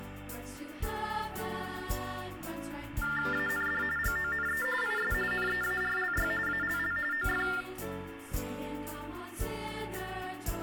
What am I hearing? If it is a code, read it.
TTY/TDD text telephone tones (45.45 baud Baudot), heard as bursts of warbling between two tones, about 400 Hz shift, 1600 Hz centre, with phone line noise and room echo. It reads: AND GONE IS NEARLY ALL OF